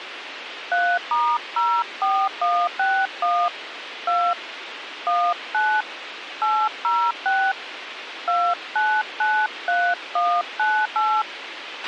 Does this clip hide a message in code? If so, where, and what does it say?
Yes: DTMF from 0.7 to 11.2 s, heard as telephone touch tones, dialled by hand, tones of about 260 ms, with radio hiss and a squelch burst at the end. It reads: 3*04161 2 19 806 2993198